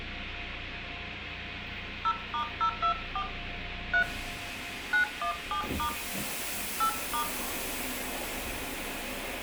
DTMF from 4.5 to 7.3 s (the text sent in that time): 917* 8*